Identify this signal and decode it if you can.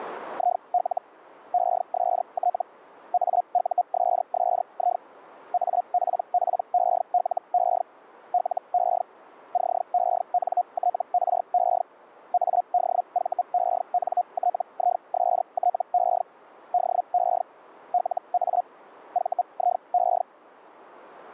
Hellschreiber (Feld-Hell, 122.5 baud), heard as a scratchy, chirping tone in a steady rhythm, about 720 Hz. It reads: IL EST AUSSI APPELE LE CENTRE ADVENTISTE DE LA VIE